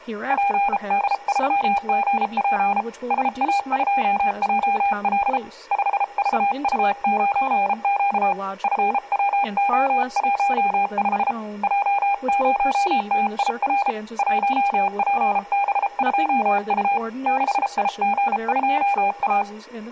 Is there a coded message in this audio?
Yes: Morse code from 0.2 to 19.5 s, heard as a keyed tone, hand-sent with a bug key, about 33 wpm, 800 Hz, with speech in English. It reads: PD3GP SA2JL 5VU9Q FWO15 J0TIR 1PB2U 6IG2A